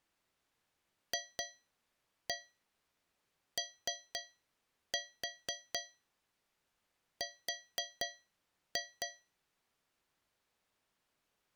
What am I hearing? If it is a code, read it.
Tap code, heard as taps on a metal pipe, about 4 knocks a second. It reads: FOR